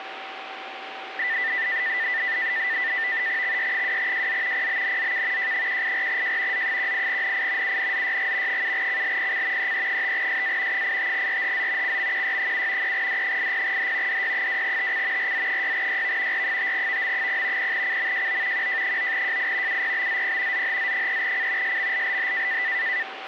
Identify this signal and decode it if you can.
NAVTEX (SITOR-B), 100 baud, 170 Hz shift, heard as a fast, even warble, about 1900 Hz centre, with radio static and a steady whistle near 770 Hz. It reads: XY2JZ PBNZK J184J Z18NI UNZYG 7CLPC EE5SA 85RHZ CMQY7 3D80H DY2TC RZ6YV R5VM0 0CMJO QJ9JI UPBZP ZHZ3C SMLLH